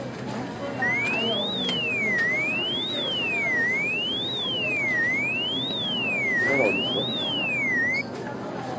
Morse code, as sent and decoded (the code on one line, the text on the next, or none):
none